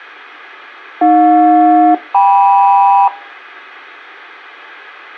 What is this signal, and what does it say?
Aircraft SELCAL, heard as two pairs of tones, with a squelch burst at the end. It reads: AJ-KM